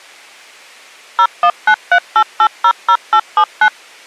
DTMF, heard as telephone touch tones, dialled by machine, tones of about 70 ms. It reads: 01938800879